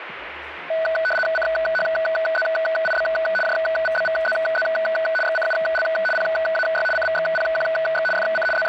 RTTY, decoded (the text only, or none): CHZIB JVBVZZ XCUL PAY CVXPQX FC …